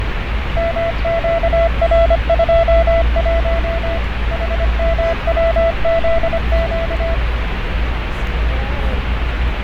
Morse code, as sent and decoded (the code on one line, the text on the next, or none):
-- --.- .-. ..--- .---- / .... -- .-- --.. --.-
MQR21 HMWZQ